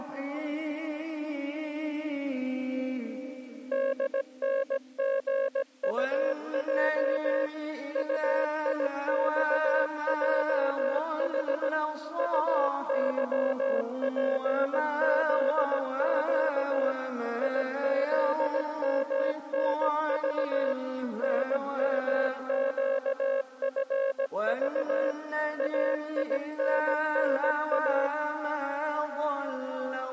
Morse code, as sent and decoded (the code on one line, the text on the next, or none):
-.. -. --. ..- .--- / ..- .. -..- .--- .... / ..- -.-- .--. --.. --.- / .. --.. -- -. ...- / -. -- --.- ..-. ...- / .- .. -. -. .-
DNGUJ UIXJH UYPZQ IZMNV NMQFV AINNA